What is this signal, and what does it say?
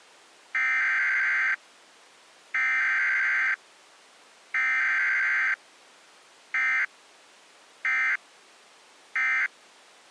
Emergency Alert System (SAME) tones (header bursts, then end-of-message bursts), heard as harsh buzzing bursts, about 520.83 baud.